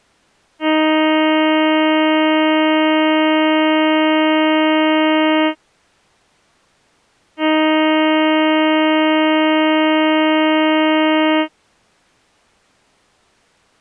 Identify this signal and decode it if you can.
Ship horn signal, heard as a ship's horn, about 310 Hz. 2 long. At sea: a vessel under power that has stopped in fog.